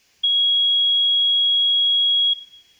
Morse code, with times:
none

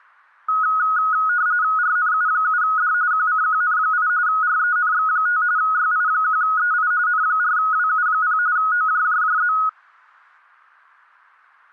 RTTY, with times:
1.8-2.9 RNU7D
3.1-4.1 QCQN8
4.3-5.4 RENX5
5.6-6.9 YI1EI
7.1-8.4 N4WU0
8.6-9.5 OJJJZ

